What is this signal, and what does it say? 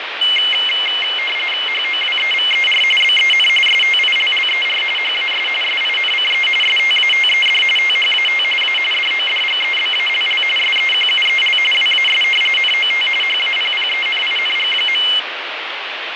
RTTY (45.45 baud, 850 Hz shift), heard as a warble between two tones, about 2550 Hz centre, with radio static and fading. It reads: HOWEVER BEN STILLER HAS SINCE STATED THAT A DODGEBALL SEQUEL WAS NOT HAPPENING.